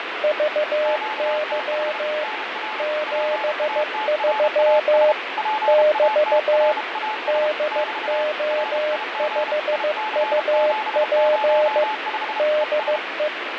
Morse code, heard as two keyed tones, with radio static and fading. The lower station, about 15 wpm, 610 Hz: VY 73 <BT> DO5UP DE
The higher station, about 32 wpm, 860 Hz: QTH NR PATRAS PATRAS <BT> RIG IC705 ES